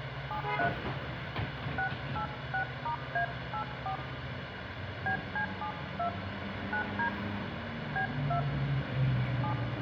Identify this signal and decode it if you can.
DTMF, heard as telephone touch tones, dialled by hand, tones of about 100 ms, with radio hiss and the noise inside a bus. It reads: 73 686*A84 BC72 9D B2 7